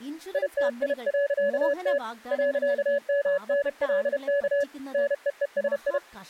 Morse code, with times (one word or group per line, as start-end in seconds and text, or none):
0.3-2.0 ITI.T
2.3-4.6 .MNLK
4.9-6.0 NEESI